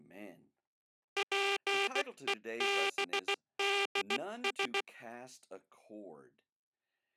Morse code, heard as a buzzer, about 16 wpm, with speech in English. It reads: PEBDS